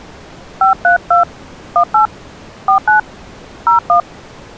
DTMF, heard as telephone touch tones, dialled by hand, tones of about 110 ms. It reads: 532 18 49 01